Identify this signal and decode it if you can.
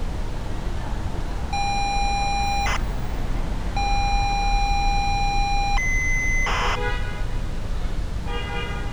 ZX Spectrum tape loading, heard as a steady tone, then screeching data, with street noise.